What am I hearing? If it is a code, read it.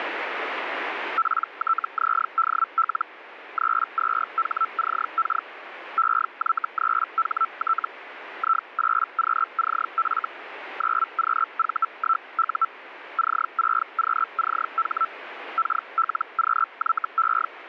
Hellschreiber (Feld-Hell, 122.5 baud), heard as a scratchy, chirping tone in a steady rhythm, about 1330 Hz, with radio static. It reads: PTZDL 32HCK EY3HT I8QCF 9QV1U C6QCH KLQYE